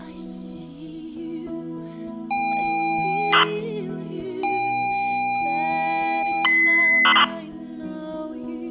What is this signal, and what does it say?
ZX Spectrum tape loading, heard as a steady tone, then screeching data.